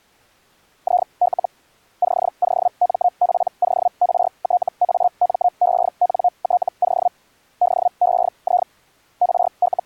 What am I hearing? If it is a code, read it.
Hellschreiber (Feld-Hell, 122.5 baud), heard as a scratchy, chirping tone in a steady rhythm, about 720 Hz. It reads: IL COMPORTAMENTO DEI …